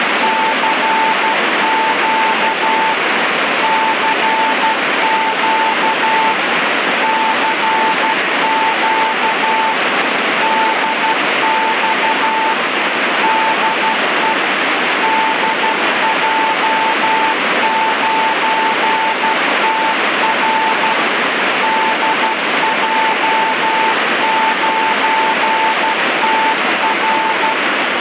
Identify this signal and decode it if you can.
Morse code, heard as a keyed tone, machine-sent, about 12 wpm, 890 Hz, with heavy radio static. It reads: CQ CQ CQ DX DE DJ9TR DJ9TR